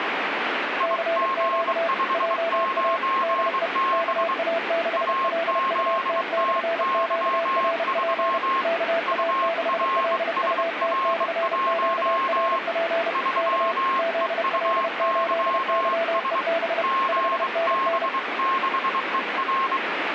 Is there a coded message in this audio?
Yes: Morse code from 0.7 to 19.8 s, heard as two keyed tones, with radio static. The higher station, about 23 wpm, 1070 Hz: IG59B AZTY3 URSR1 3EUYS GB6ER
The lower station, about 31 wpm, 670 Hz: CQ JA DE KA6LUT/QRP KA6LUT/QRP K ZL8YEB 5NN